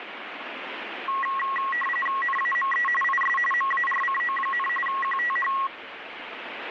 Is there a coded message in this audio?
Yes: RTTY (45.45 baud, 850 Hz shift) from 1.1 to 5.7 s, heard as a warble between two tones, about 1500 Hz centre, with radio static. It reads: NAME IS MARCO, QTH